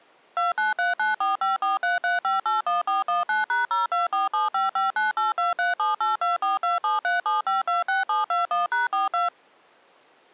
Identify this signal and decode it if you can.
DTMF, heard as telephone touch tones, dialled by machine, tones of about 150 ms. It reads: 293945433581419#024755982378242737526721#42